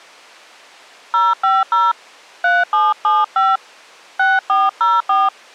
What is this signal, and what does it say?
DTMF, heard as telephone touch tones, dialled by hand, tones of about 200 ms. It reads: 050 3775 6404